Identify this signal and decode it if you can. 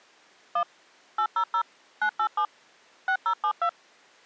DTMF, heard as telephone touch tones, dialled by machine, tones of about 80 ms. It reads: 1 800 987 6072